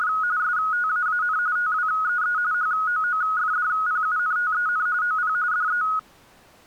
RTTY (45.45 baud, 170 Hz shift), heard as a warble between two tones, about 1360 Hz centre. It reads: … STAAN TWEE HOOFDPUNTEN OP DE